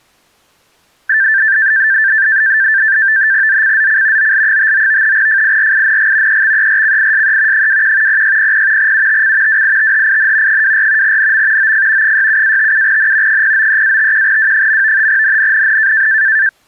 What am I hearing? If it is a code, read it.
NAVTEX (SITOR-B), 100 baud, 170 Hz shift, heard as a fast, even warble, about 1650 Hz centre. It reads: ZCZC OL59 FIRING EXERCISE 21 0600 UTC WITHIN 24 NM OF 67-57N 093-51W. NNNN